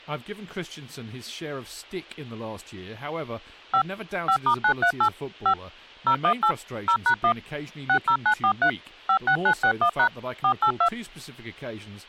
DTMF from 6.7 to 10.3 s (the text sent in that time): 0#1 60943 56961#